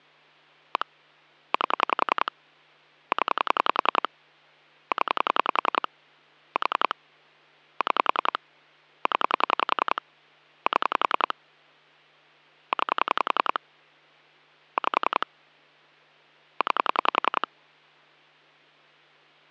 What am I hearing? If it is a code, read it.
Pulse dialling, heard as clicks on a phone line, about 10 pulses a second, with hum. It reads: 1 8 0 0 4 6 0 7 9 5 9